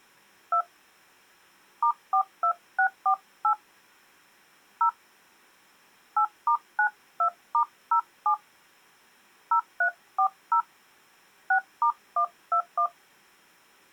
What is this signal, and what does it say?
DTMF, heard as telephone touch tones, dialled by hand, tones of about 90 ms. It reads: 2 *42648 0 8*92*07 0340 6*121